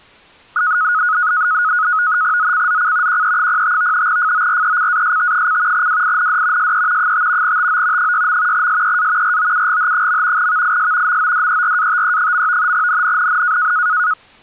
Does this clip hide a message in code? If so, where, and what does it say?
Yes: NAVTEX (SITOR-B), 100 baud, 170 Hz shift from 0.6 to 14.1 s, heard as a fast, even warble, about 1360 Hz centre. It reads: ZCZC QE05 FORECAST: WIND SE 5 TO 6. SEA ROUGH. VIS MODERATE. NNNN